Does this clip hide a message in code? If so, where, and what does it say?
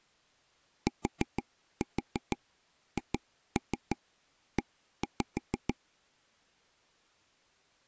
Yes: tap code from 0.9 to 5.7 s, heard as taps on a table, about 6 knocks a second. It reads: THE